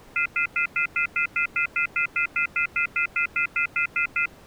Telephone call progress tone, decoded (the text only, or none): off-hook warning tone